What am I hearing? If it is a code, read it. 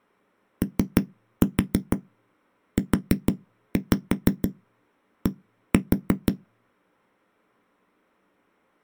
Tap code, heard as knocks on a wall, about 6 knocks a second. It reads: OUD